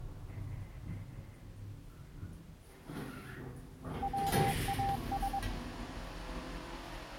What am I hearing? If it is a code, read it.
Morse code, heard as a keyed tone, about 22 wpm, 790 Hz, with the noise inside a lift. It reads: WAS